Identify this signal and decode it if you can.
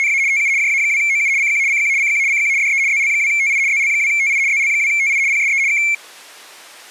RTTY (75 baud, 170 Hz shift), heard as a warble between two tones, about 2250 Hz centre. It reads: … TU JA2OU CQ CQ CQ CQ DE ZL2TI ZL2TI ZL2TI PSE K